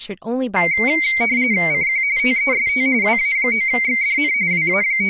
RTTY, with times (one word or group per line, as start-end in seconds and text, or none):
1.7-2.0 CQ
2.2-2.9 TEST
3.0-4.3 WA9XDN
4.5-5.1 …